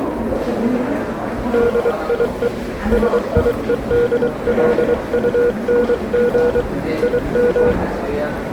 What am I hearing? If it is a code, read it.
Morse code, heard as a keyed tone, hand-sent with a paddle, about 23 wpm, 480 Hz, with the noise of a subway station. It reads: DIE SIEDLUNG IM